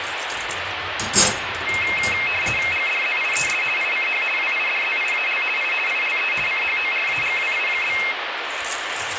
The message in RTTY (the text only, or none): GDZIES ICH WIDZIAL I ILE CHORAGWI?